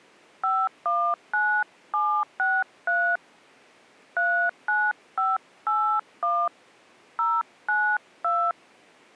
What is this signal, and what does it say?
DTMF, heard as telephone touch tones, dialled by hand, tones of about 250 ms. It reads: 519763 39581 092